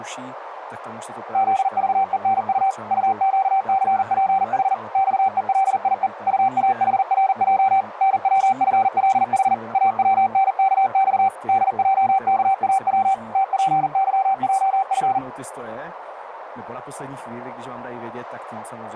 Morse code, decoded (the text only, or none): ZVENU UQCPH XELIE UAHRJ NWFLH AWNKX DJKAW TPYJF